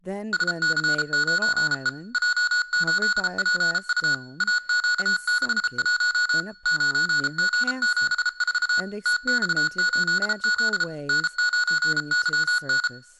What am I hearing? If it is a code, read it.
Morse code, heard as electronic beeps, machine-sent, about 33 wpm, 1460 Hz, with speech in English. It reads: SC9E J8PU AQ61 9G74 TX8Z N9YN